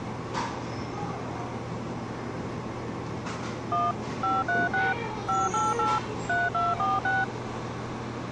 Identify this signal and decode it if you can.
DTMF, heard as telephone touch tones, dialled by machine, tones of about 190 ms, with the noise of a cafe. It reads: 1 536 588 3246